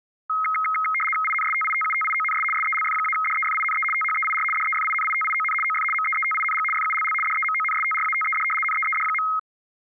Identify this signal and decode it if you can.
RTTY (75 baud, 850 Hz shift), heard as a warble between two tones, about 1700 Hz centre. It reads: INSTITUTIONS SELF-DEFINE THEIR DEFINITION OF MEETING FULL DEMONSTRATED NEED.